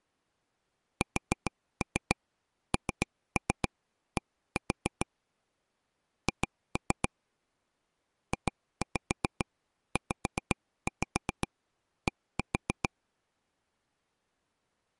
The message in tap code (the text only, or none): SND H JZD